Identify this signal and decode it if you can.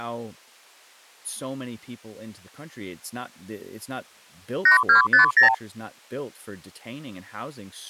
Multi-frequency trunk signalling (R2, with the far end's replies), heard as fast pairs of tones, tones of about 120 ms, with speech in English. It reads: 8250